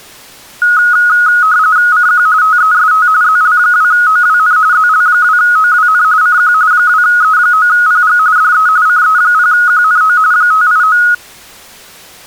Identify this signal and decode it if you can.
RTTY (45.45 baud, 170 Hz shift), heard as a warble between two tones, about 1360 Hz centre. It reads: CQ TEST ZL2OWN ZL2OWN CQ 2E9PG DE CE0QNO 589